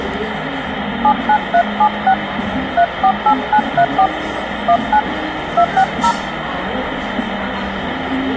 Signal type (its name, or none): DTMF